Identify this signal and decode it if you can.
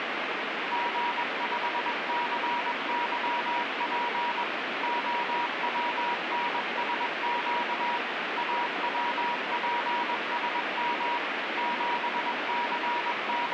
Morse code, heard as a keyed tone, machine-sent, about 21 wpm, 960 Hz, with heavy radio static. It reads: G5CYP OWNSQ AWPSM …